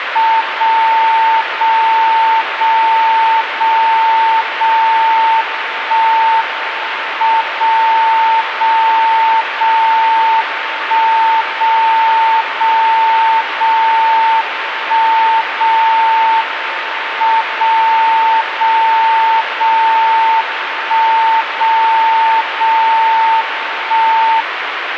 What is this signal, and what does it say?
Radio time signal (WWVB), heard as a tone whose level steps once a second, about 900 Hz, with radio static. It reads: 0 0 0 0 0 1 M 0 0 0 1 0 0 0 1 0 M 0 0 0 1 0 0 1